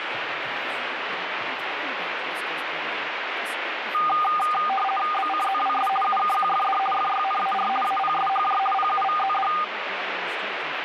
RTTY (50 baud, 450 Hz shift), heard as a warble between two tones, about 1000 Hz centre, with radio static. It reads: BCZWS UKQFD FYNAR APSHJ PUVZD